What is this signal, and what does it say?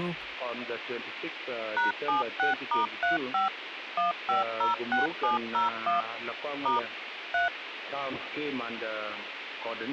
DTMF, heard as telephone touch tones, dialled by machine, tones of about 140 ms, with phone line noise. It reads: #76*35 1506701 * 3